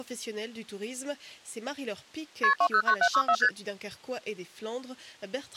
Multi-frequency trunk signalling (R1, as on North American trunks), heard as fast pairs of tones, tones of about 70 ms. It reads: KP 209764 ST